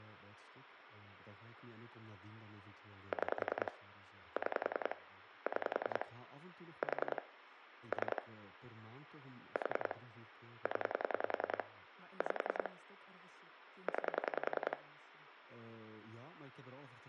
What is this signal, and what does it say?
Pulse dialling, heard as clicks on a phone line, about 10 pulses a second, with phone line noise, room echo and speech in Dutch. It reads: 6 6 6 4 3 4 0 5 9